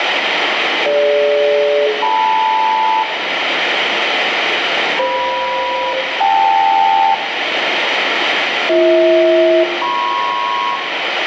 Aircraft SELCAL, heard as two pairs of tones, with radio static and room echo. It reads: DG-LM FM-KL BH-MP